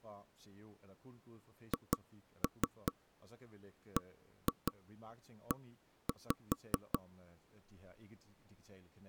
Tap code, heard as knocks on wood, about 4 knocks a second, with speech in Danish. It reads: HBE